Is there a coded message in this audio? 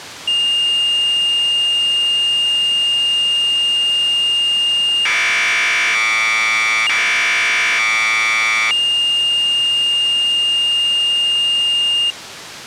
Yes: Commodore tape loading (standard loader) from 0.3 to 12.1 s, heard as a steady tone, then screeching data.